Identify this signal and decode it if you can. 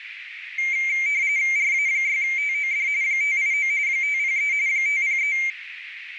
RTTY (45.45 baud, 170 Hz shift), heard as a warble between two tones, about 2200 Hz centre, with radio static and a narrow filter. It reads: RA6TOD 589 503 503